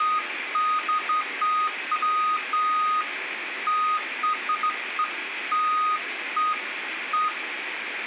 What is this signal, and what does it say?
Beeps of irregular length, with phone line noise and room echo. There is no code.